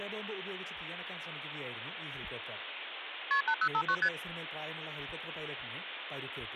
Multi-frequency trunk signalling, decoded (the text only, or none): KP 8059 ST